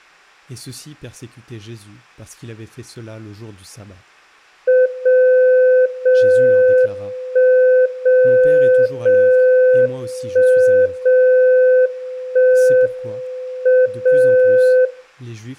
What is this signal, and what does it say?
Radio time signal (WWVB), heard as a tone whose level steps once a second, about 510 Hz, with speech in French. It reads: 0 0 1 0 0 1 0 1 M 0